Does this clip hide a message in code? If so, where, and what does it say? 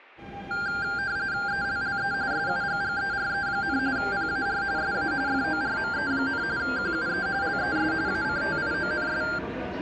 Yes: RTTY (45.45 baud, 170 Hz shift) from 0.5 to 9.4 s, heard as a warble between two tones, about 1490 Hz centre, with the noise inside a subway train. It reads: ELLE SUGGERE, PAR SA FORME, QUE LES ACTIONS